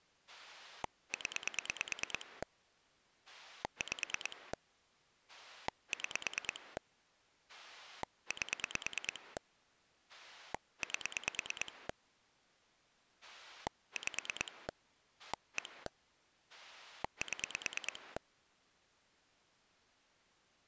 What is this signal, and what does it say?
Pulse dialling, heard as a rotary dial, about 9 pulses a second. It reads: 0 5 6 8 8 5 1 7